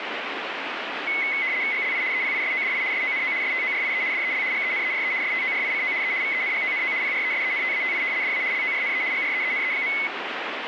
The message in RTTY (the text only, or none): GLI EPISODI SONO STORIE DEL GENERE STORICO E VENGONO PRESENTATI DA LORNE GREENE.